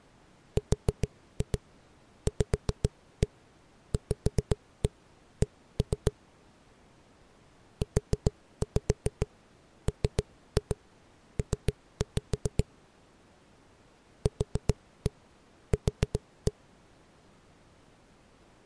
Tap code, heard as knocks on a wall, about 7 knocks a second. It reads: RVVC UMP QQ